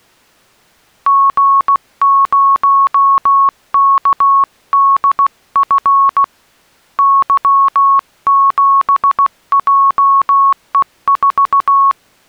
Morse code, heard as a keyed tone, hand-sent with a paddle, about 16 wpm, 1100 Hz. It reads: G0KDF Y7JE4